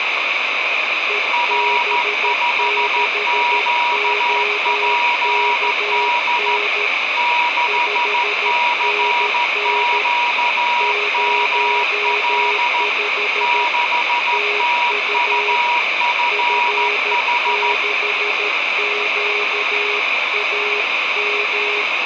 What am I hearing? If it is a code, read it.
Morse code, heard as two keyed tones, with heavy radio static. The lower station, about 13 wpm, 420 Hz: EB6OKN 5NN 05 TU F6QAM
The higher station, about 14 wpm, 960 Hz: R5QPD 6CQML 6TUFH